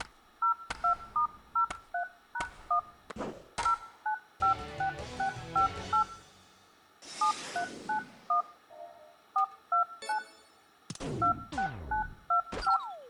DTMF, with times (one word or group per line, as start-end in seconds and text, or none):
0.4-2.8 02*03#1
3.6-6.0 0956658
7.2-8.4 7391
9.4-10.2 429
11.2-12.8 26925